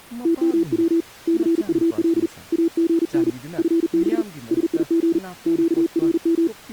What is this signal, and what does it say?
Morse code, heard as a keyed tone, hand-sent with a paddle, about 40 wpm, 330 Hz, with speech in Manipuri. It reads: TMW CUL AGN FB SIG QRM